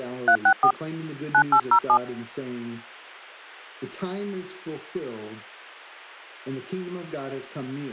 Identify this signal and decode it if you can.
DTMF, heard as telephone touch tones, dialled by hand, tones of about 80 ms. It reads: 364 9807